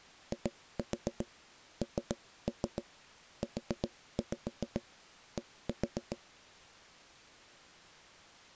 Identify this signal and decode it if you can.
Tap code, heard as knocks on wood, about 7 knocks a second. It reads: INUD